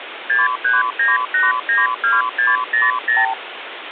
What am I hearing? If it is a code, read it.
Multi-frequency trunk signalling (R2, with the far end's replies), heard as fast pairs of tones, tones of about 170 ms, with phone line noise. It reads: 639892600